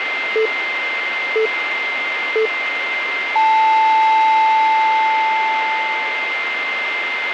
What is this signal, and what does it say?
Radio time signal (three low pips and a long one an octave up, as on NHK), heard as pips, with radio static and a steady whistle near 2090 Hz.